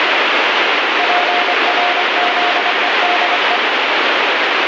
Morse code, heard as a keyed tone, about 25 wpm, 710 Hz, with heavy radio static. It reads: PRZEDE